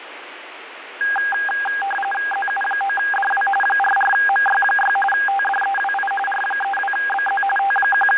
RTTY (45.45 baud, 850 Hz shift), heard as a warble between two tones, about 1220 Hz centre, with radio static. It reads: ZU9DW 44MY6 TDEWI R32BZ …